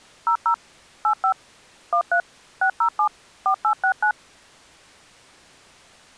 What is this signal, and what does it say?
DTMF, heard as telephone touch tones, dialled by machine, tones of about 90 ms. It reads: 00 85 13 607 4869